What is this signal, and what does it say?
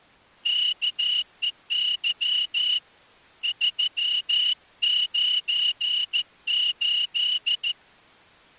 Morse code, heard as a whistle, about 14 wpm. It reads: KEY 398